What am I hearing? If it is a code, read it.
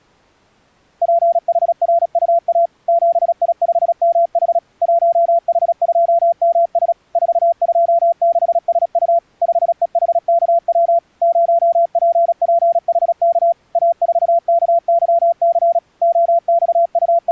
Morse code, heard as a keyed tone, machine-sent, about 36 wpm, 680 Hz. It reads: PHRUA 7I5MH 1H2MS 426SU 5EHKW 0PPHK A4KYC …